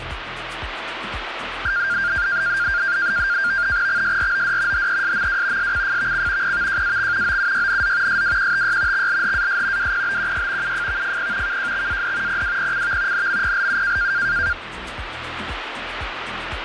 NAVTEX (SITOR-B), 100 baud, 170 Hz shift, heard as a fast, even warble, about 1500 Hz centre, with radio static. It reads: XSROD HESMW SCFVC PVJAX OUYNZ SWQTY XLHAS WPBQY UFVFP KJXAD PWPCV NMPLU